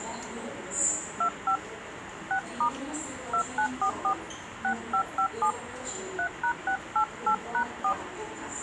DTMF, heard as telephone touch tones, dialled by hand, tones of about 90 ms, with radio hiss, a squelch burst at the end and the noise of a subway station. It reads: 25 6* 2944 6557 3#688#4